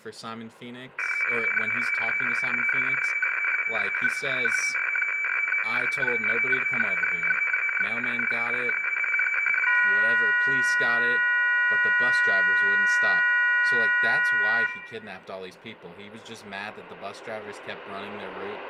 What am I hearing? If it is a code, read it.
Weather fax (radiofax), 120 lines a minute, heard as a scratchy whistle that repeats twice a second, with room echo and speech in English.